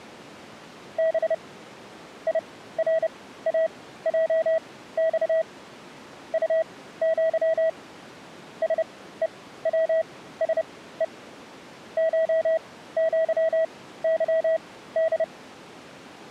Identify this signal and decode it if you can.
Morse code (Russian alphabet), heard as a keyed tone, machine-sent, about 30 wpm, spaced as for 16 wpm, 650 Hz. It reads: Б ИРАЙЬ УЪ СЕВСЕ ШЪЫД